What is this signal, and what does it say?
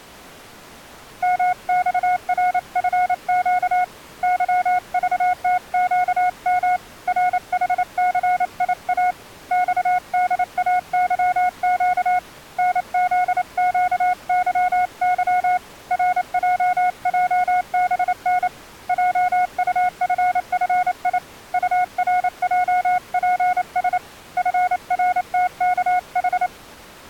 Morse code, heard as a keyed tone, hand-sent with a paddle, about 28 wpm, 730 Hz. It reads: MXRFQ YVTQM RHCIA XDAYQ NZQYY RJJBN JUFFI URJPS FRTKH